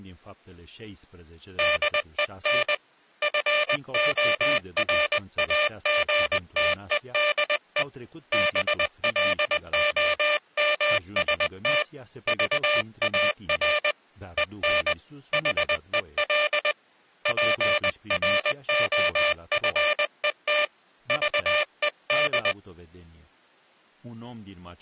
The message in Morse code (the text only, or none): DEN FORAGTEDE BLOMST VAR EN HEL PROFET VED